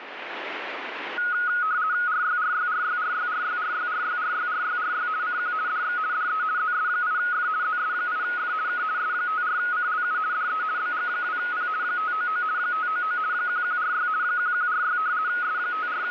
RTTY (50 baud, 170 Hz shift), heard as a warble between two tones, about 1360 Hz centre, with radio static. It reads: RYRYRYRYRYRYRYRYRYRY CQ DX DE ZS8F ZS8F K S54CLU DE BG2P 599 599 1146 1146 …